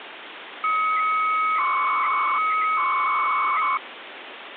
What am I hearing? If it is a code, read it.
300-baud modem data (Bell 103 tones), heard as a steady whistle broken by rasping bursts, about 300 baud, 200 Hz shift, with phone line noise.